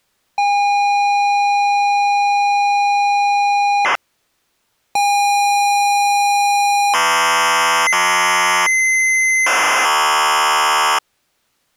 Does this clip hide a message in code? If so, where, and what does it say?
Yes: ZX Spectrum tape loading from 0.4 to 11.0 s, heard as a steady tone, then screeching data.